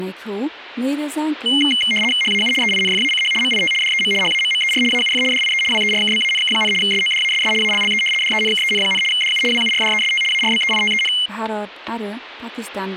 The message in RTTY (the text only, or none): HAU EINFACH MIT DEM HAMMER AUF DIE WERKBANK, SODASS ALLE DENKEN, DU WURDEST ARBEITEN